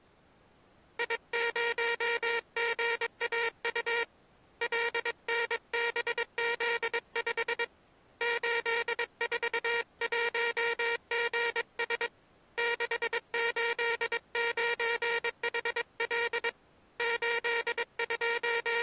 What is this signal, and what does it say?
Morse code, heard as a buzzer, hand-sent with a paddle, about 22 wpm. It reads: I0GAU LNBZ5 841GS 689HL …